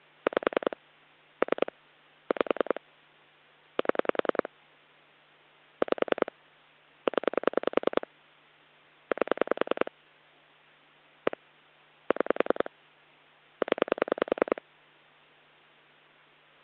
Pulse dialling, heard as clicks on a phone line, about 10 pulses a second. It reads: 5 3 5 7 5 0 8 1 6 0